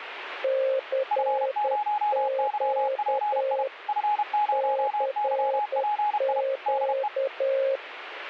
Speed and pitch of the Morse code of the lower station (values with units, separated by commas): 10 wpm, 540 Hz